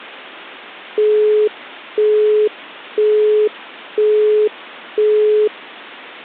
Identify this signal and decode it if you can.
Telephone call progress tone (single-tone plan, as in Europe, Japan and elsewhere), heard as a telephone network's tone, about 420 Hz, 0.5 s on and 0.5 s off. Busy tone.